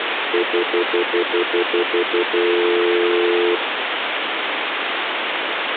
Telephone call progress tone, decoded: stutter dial tone

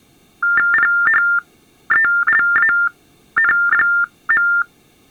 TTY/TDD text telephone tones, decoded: PHELAN.

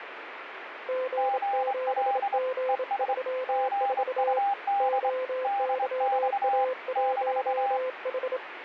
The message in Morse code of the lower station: G7G34 OYA1H

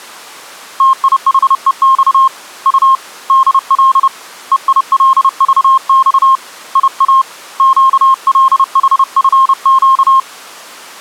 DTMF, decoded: none

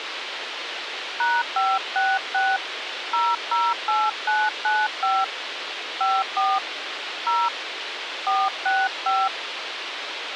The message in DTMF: #566 008995 54 0 465

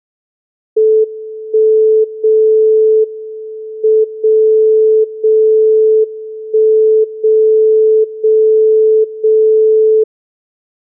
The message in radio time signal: 1 0 M 0 0 1 0 0 0

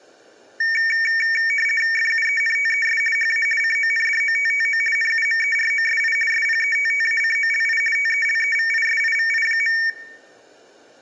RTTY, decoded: FUENTES HA CONDOTTO NUMEROSI SPETTACOLI TELEVISIVI.

